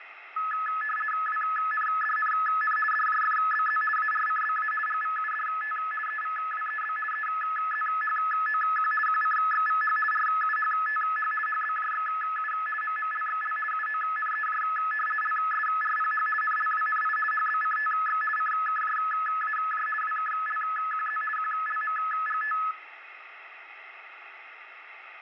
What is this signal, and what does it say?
RTTY (50 baud, 450 Hz shift), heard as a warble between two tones, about 1500 Hz centre, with radio static. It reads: WNDNN DJFBZ ARCBA GVUDT EVWEB EZHOQ QCXVH RUHTH HBJXU MMLXL UONEJ LSRPH NLWNI HBCTX CKJAJ WKLQZ QLMGT